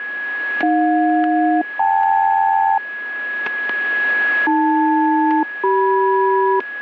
Aircraft SELCAL, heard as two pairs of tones, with static crashes and a steady whistle near 1670 Hz. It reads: AJ-KL AL-CM